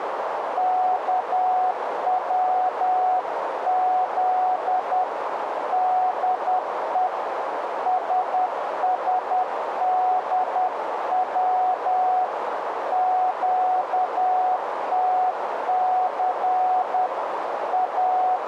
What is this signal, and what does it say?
Morse code, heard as a keyed tone, hand-sent with a paddle, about 10 wpm, 740 Hz, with radio static and a narrow filter. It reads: KWZ DE SSDW QTC …